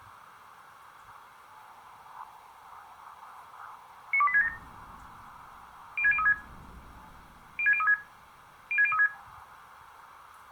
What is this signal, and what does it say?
Five-tone selective call (ZVEI), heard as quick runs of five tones, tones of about 70 ms, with room echo. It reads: 92867 06036 06036 06036